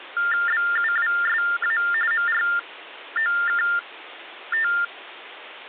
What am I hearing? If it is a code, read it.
TTY/TDD text telephone tones (45.45 baud Baudot), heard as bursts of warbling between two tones, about 400 Hz shift, 1600 Hz centre. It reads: BUWSA MROKT